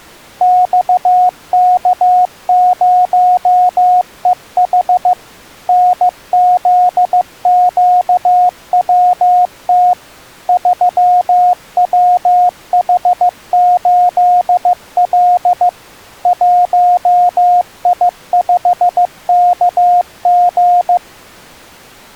Morse code, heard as a keyed tone, machine-sent, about 15 wpm, 720 Hz. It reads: XK0EH NZQWT 3WH8L 1I5KG